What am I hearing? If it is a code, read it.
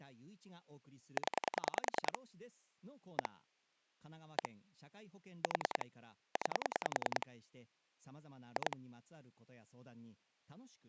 Pulse dialling, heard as clicks on a phone line, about 10 pulses a second, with speech in Japanese. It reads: 0 1 1 4 9 2